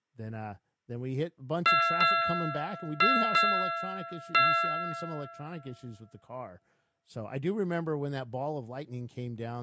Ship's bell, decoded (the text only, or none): 5